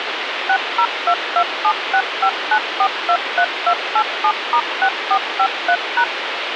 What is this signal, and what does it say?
DTMF, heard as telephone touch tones, dialled by machine, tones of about 70 ms, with phone line noise. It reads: 60227659423287*6453#